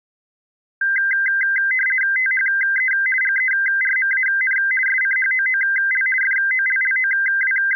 RTTY (50 baud, 450 Hz shift), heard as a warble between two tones, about 1800 Hz centre. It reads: THE GERMAN SCHOOL …